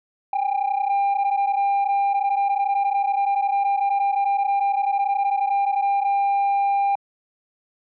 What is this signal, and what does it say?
PSK31 (31.25 baud), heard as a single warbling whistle, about 800 Hz.